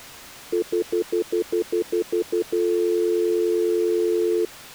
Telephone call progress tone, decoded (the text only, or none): stutter dial tone